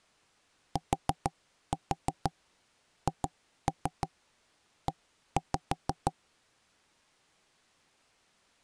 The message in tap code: THE

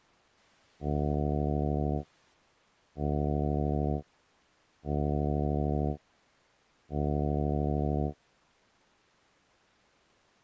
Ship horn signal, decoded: 4 short

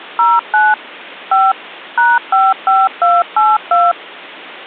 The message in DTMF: 09 5 #55282

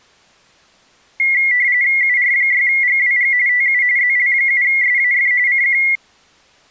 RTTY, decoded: UR6GWG TU ZL7SAF CQ

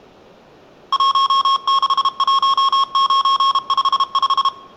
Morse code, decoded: 161955

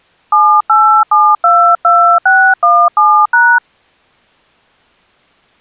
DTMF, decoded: 78722617#

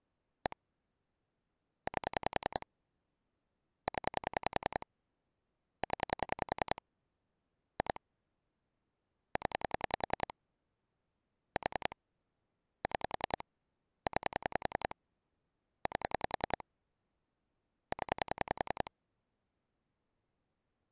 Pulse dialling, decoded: 1 8 0 0 2 0 4 6 9 8 0

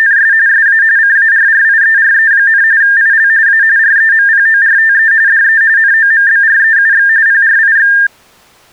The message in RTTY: … SA CARRIERE, IL A REMPORTE DE NOMBREUX PRIX

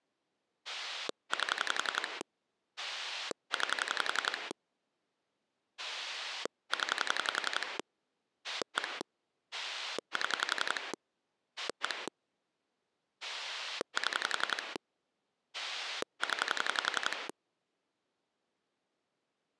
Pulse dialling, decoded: 8 9 0 1 7 1 7 0

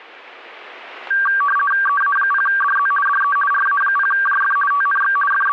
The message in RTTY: EA0DZ DE RA0JF TNX …

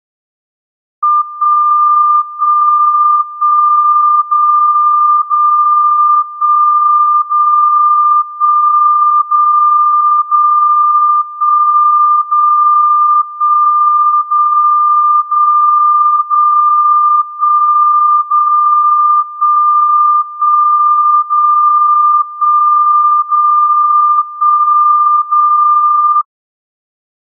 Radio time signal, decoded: 1 1 1 0 0 1 0 1 0 0 1 0 1 0 0 0 1 0 1 1 0 1 0 1 0

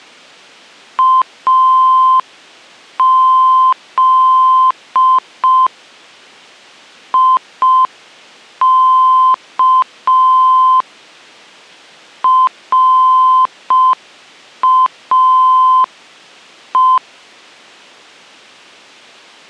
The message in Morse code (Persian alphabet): از یک راه

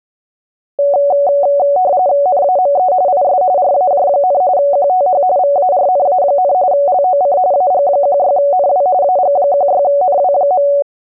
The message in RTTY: NAME IS RAJ, QTH VARNA, LOC AG16NW AG16NW.

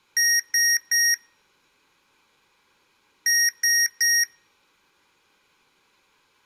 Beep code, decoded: 3 short

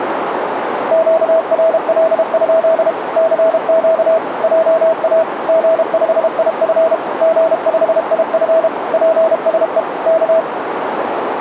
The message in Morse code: QRL? CQ JA G5IF G5IF PSE K

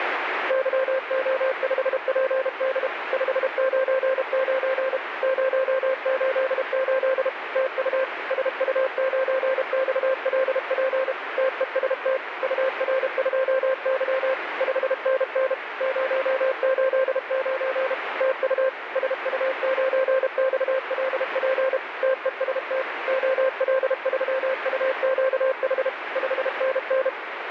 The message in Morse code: YO5PD 599 088 TU SU9XLP TEST UR2Y 5NN 089 TU SU9XLP TEST OL3UQH 5NN

